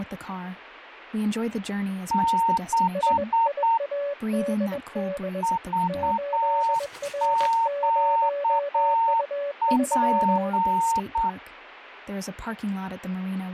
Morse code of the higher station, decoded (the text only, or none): 6 VQP